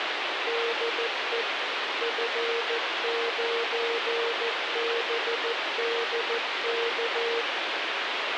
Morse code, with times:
0.5-1.4 DE
2.0-7.4 F9BDK

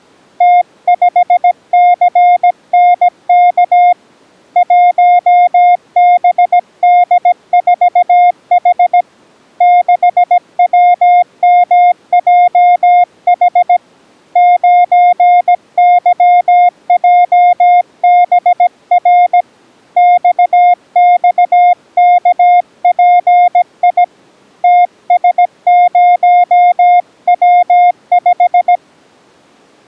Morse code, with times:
0.4-3.9 T5CNK
4.6-9.0 1BD4H
9.6-13.8 6WMJH
14.4-19.4 9YJBR
20.0-24.0 XXKPI
24.6-28.8 TS0W5

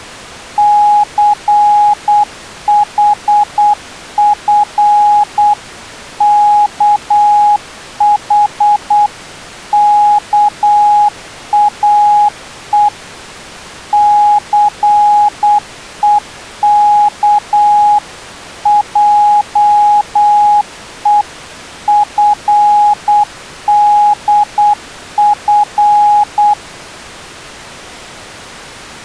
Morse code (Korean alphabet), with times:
0.6-12.9 춘우와
13.9-26.5 창하는

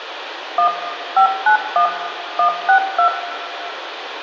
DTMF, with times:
0.6-0.7 1
1.2-1.9 591
2.4-3.1 162

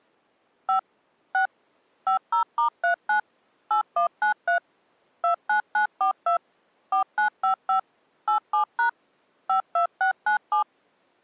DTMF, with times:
0.7-0.8 5
1.3-1.5 6
2.1-3.2 50*39
3.7-4.6 8193
5.2-6.4 29942
6.9-7.8 4955
8.3-8.9 87#
9.5-10.6 52697

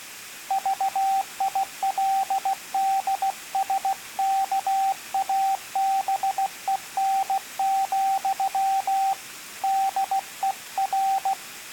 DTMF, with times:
none

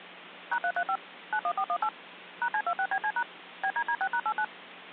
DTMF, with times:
0.5-1.0 #335
1.3-1.9 91418
2.4-3.2 #C26BC#
3.6-4.4 BDD6#89

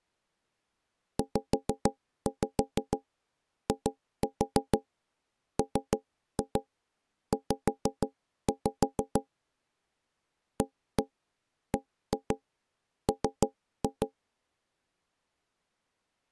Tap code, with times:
1.2-9.2 ZIMZ
10.6-14.1 ABM

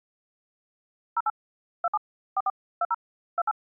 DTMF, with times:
1.2-1.3 08
1.8-2.0 27
2.4-2.5 44
2.8-2.9 20
3.4-3.5 28

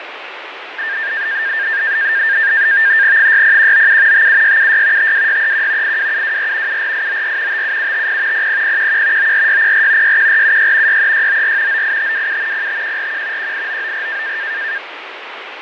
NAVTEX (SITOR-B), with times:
3.2-4.3 60197
4.1-5.1 57676
5.0-6.0 52631
5.8-6.8 82724
6.7-7.6 74894
7.5-8.5 57750
8.3-9.3 00011
9.2-10.2 94604
10.0-11.0 61476
10.9-11.8 63694
11.7-12.7 98527
12.5-13.5 05141
13.4-14.4 18994

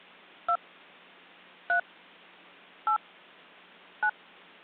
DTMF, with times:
0.5-0.6 2
1.7-1.8 3
2.9-3.0 8
4.0-4.1 9

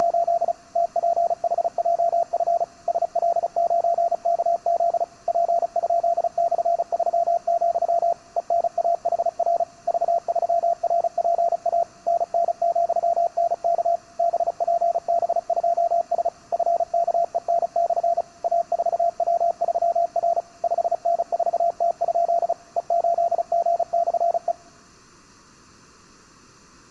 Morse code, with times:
0.0-0.5 …
0.8-2.6 TPHJF
2.9-5.0 SL9KZ
5.3-8.1 P?/3,
8.4-9.6 ENAHR
9.9-11.8 V3RPA
12.1-14.0 NN,NK
14.2-16.3 BPB2S
16.5-18.2 FKEN/
18.4-20.4 A4W3R
20.6-22.5 5N4T?
22.8-24.5 E8G/E

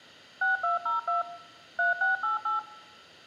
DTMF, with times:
0.4-1.2 6202
1.8-2.6 3688

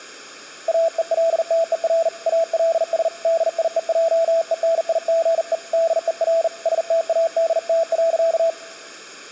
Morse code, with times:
0.7-2.1 AELTER
2.3-3.1 ALS
3.2-5.5 DIEJENIGE
5.7-6.5 DER
6.7-8.5 STADT.

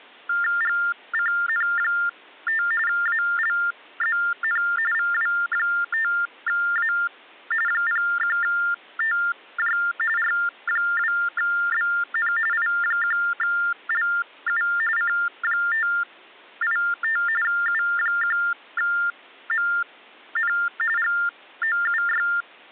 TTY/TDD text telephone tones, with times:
0.6-2.6 GCN5
2.9-4.6 ALZN
4.9-6.9 VW5A
7.7-9.8 01TJ
10.2-12.3 R2BN
12.5-14.6 I1LU
15.0-17.2 C585
17.4-20.5 U1MN
21.0-22.3 GOUY

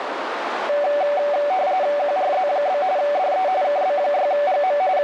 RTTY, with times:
2.0-2.8 QRZ?
3.0-3.5 DE
3.6-4.8 KB6GM
5.0-5.0 …

